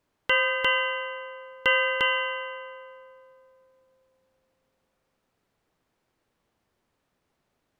Ship's bell, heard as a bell. 4. Four half-hours of the watch have passed.